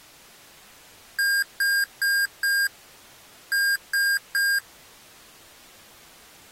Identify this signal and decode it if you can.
Beep code, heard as beeps from a small speaker, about 1600 Hz. 4-3.